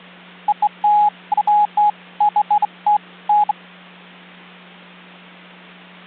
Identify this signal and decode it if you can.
Beeps of irregular length, with hum. There is no code.